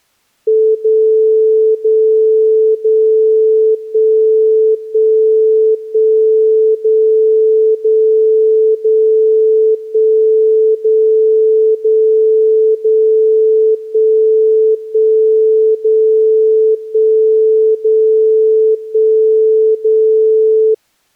Radio time signal (DCF77), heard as a tone whose level steps once a second, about 440 Hz. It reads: 0 0 0 1 1 1 0 0 0 1 0 0 0 1 1 0 1 0 1 0